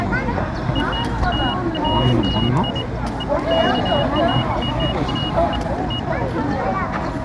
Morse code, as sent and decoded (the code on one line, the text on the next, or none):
none